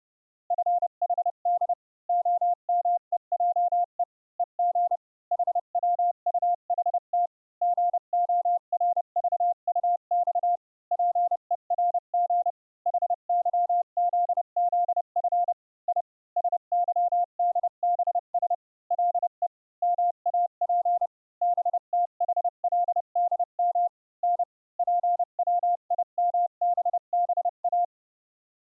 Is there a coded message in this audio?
Yes: Morse code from 0.4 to 27.9 s, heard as a keyed tone, machine-sent, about 30 wpm, spaced as for 27 wpm, 700 Hz. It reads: FHD OMEJE EG HWUHT GORVUX PERG HYZZF I SYDBS LE MAP BTHLDM N PWIMBBA